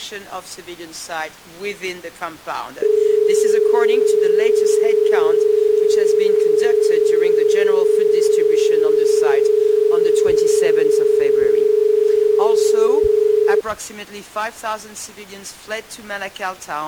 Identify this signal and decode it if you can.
Telephone call progress tone (as in Australia), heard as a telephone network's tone, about 430 Hz. Dial tone.